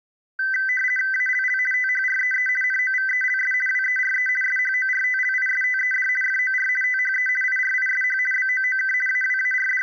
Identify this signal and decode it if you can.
RTTY (50 baud, 450 Hz shift), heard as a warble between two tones, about 1800 Hz centre. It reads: ALL THREE NOVELS WERE SHORTLISTED FOR THE IRISH BOOK …